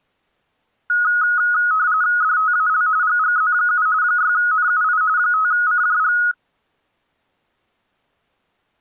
RTTY (45.45 baud, 170 Hz shift), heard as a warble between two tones, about 1360 Hz centre. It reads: DTAL GGZ7 6NUI 5CJG